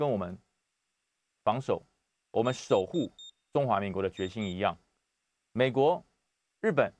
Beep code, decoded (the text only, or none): 4-2